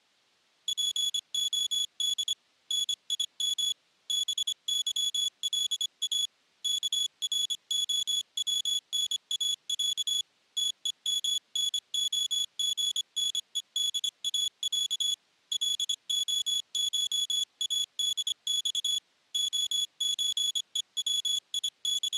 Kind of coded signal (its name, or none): Morse code